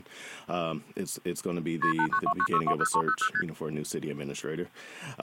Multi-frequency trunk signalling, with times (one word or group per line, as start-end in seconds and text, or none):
1.8-1.9 KP
2.0-3.3 8929620300
3.3-3.4 ST